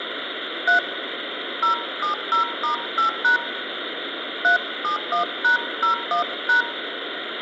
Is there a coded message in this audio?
Yes: DTMF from 0.7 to 6.6 s, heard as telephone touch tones, dialled by hand, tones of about 120 ms, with phone line noise. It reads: 3 070*8# 371#01#